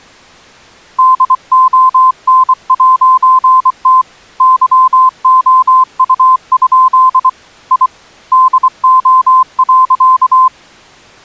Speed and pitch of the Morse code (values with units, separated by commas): 24 wpm, 1030 Hz